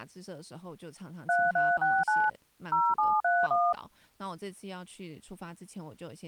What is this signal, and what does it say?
DTMF, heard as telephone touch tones, dialled by machine, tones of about 220 ms, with speech in Chinese. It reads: 3369 0731